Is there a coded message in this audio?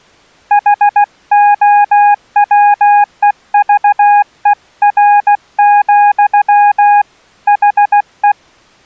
Yes: Morse code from 0.5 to 8.4 s, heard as a keyed tone, hand-sent with a paddle, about 16 wpm, 820 Hz. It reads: HOWEVER, HE